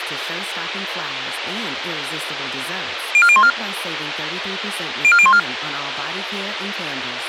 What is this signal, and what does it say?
Five-tone selective call (ZVEI), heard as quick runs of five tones, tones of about 70 ms, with radio hiss and speech in English. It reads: 04014 04014